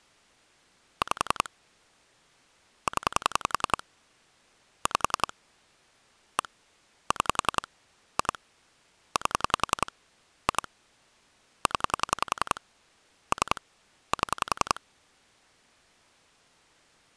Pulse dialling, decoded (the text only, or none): 5 0 5 1 6 2 8 2 0 3 7